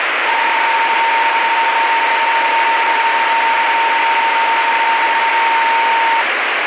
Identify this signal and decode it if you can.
PSK31 (31.25 baud), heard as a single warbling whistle, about 920 Hz, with radio static.